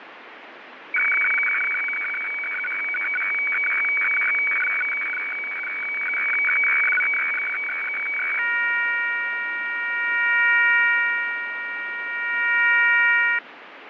Weather fax (radiofax), 120 lines a minute, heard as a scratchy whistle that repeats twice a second, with radio static and fading.